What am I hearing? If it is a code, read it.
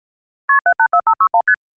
Multi-frequency trunk signalling (R1, as on North American trunks), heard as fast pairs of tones, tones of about 70 ms. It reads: KP 784561 ST